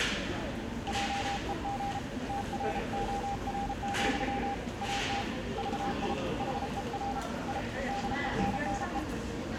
Morse code, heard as a keyed tone, hand-sent with a paddle, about 33 wpm, 800 Hz, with the noise of a crowd indoors. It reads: JEG TROR, AT VI HER I DENNE